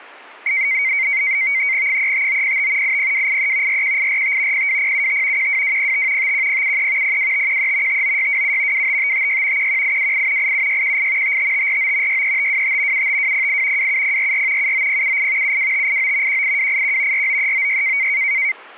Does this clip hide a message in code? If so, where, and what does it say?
Yes: NAVTEX (SITOR-B), 100 baud, 170 Hz shift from 0.5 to 18.5 s, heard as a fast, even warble, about 2150 Hz centre. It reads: 35905 80283 41845 02075 12205 51073 02513 59627 25556 11828 87618 55549 63525 75208 27044 79078 72589 18281 49396